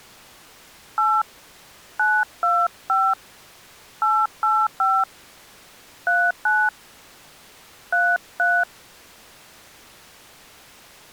DTMF, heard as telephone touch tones, dialled by hand, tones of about 240 ms. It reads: 8 925 885 39 33